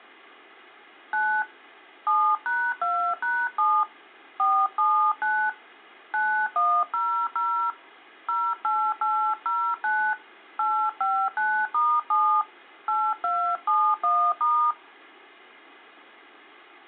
DTMF, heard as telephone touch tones, dialled by hand, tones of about 300 ms. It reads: 9 7#2#7 479 9100 08809 859*7 8271*